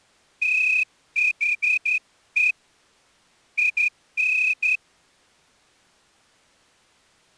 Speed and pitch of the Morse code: 11 wpm

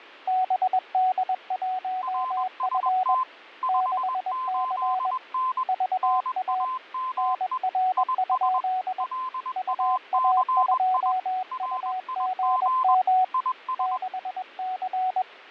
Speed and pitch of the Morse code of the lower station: 21 wpm, 740 Hz

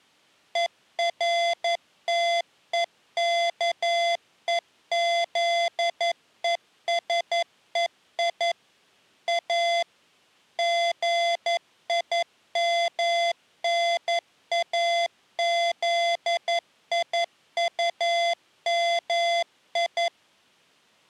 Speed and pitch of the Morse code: 11 wpm, 680 Hz

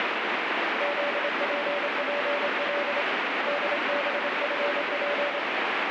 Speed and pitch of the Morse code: 27 wpm, 580 Hz

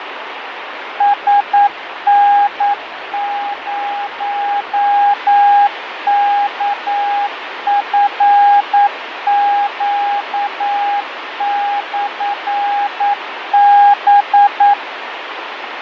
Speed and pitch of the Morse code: 9 wpm, 810 Hz

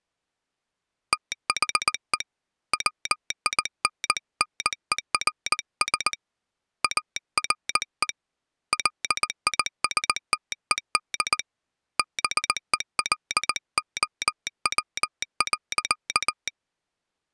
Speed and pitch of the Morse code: 19 wpm

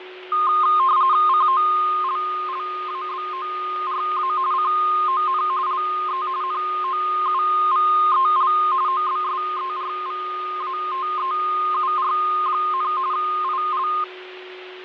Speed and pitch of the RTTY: 45.45 baud, 170 Hz shift, 1140 Hz centre

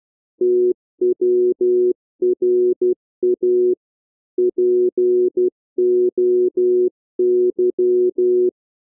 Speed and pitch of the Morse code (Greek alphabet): 12 wpm, 360 Hz

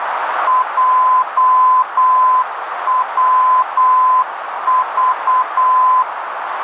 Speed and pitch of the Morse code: 8 wpm, 1020 Hz

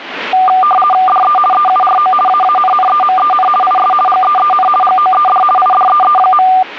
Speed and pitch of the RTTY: 50 baud, 450 Hz shift, 970 Hz centre

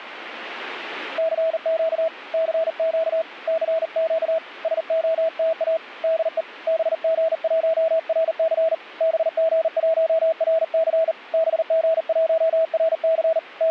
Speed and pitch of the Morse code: 39 wpm, 650 Hz

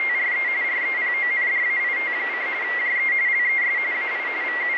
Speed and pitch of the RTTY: 45.45 baud, 170 Hz shift, 2050 Hz centre

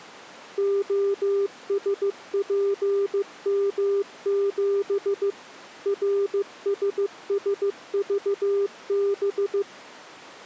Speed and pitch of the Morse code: 15 wpm, 400 Hz

